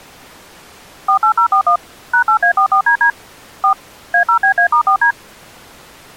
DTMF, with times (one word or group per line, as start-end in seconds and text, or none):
1.1-1.8 48041
2.1-3.1 #8A44DD
3.6-3.7 4
4.1-5.1 A0BA*4D